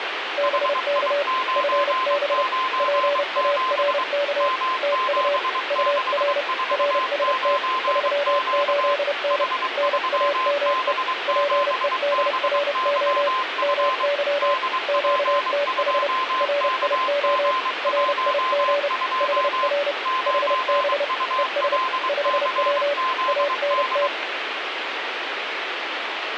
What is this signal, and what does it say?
Morse code, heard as two keyed tones, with radio static. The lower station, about 30 wpm, 570 Hz: BK FB PARK TU UR RST 38N NAME PEDRO MY QTH RIO RIG HR HB ES 5W ANT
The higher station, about 23 wpm, 1040 Hz: HI997 M7649Q H3B7BYF DP2KG12 9ULCZD